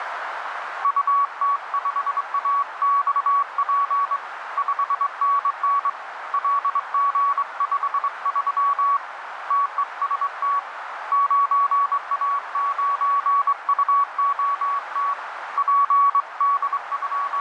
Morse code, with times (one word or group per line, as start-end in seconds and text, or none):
0.8-4.2 UT5AXP
4.6-5.9 5NN
6.3-9.0 LG53
9.5-10.6 TEST
11.1-15.1 9A9UOT
15.6-17.4 …